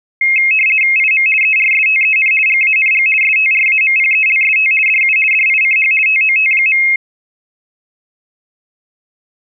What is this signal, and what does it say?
RTTY (50 baud, 450 Hz shift), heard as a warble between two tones, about 2350 Hz centre. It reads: IM ERSTEN GANG STRAMPELST DU DICH TOT.